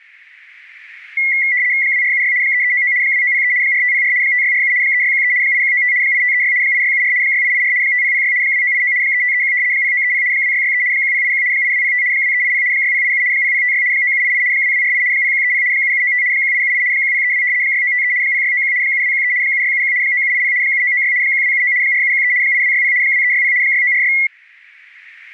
RTTY (75 baud, 170 Hz shift), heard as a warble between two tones, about 2050 Hz centre. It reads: 2476 3399 2903 4504 5647 3613 8195 8536 8674 6884 5006 2989 3531 0930 2663 1081 8205 2380 6087 0056 9788 2248 0130 7795 1878 1032 6953 0691 7213 7671 9780 7996 1279 4713 8260 2360 6946